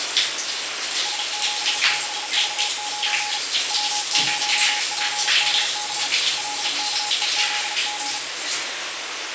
Morse code, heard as a keyed tone, hand-sent with a paddle, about 36 wpm, 840 Hz, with heavy radio static and the noise of a restroom. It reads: S76V9 W0PDB LKEZG